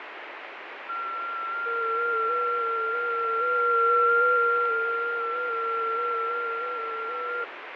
FT8 (several signals at once), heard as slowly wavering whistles, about 6.25 baud, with radio static and fading.